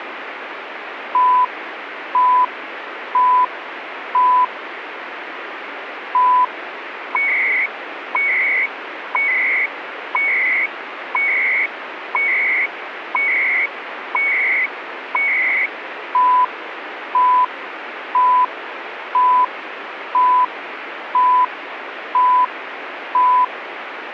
Radio time signal (CHU, Canada), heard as beeps and data bursts, one a second, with radio static.